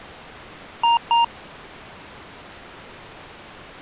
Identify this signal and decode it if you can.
Beep code, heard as beeps from a small speaker, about 930 Hz. 2 short. In AMI BIOS tables: memory parity error; in IBM BIOS tables: self-test error shown on screen; in Dell tables: no memory detected.